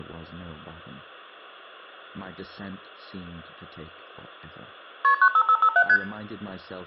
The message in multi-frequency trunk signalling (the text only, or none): KP 95557 ST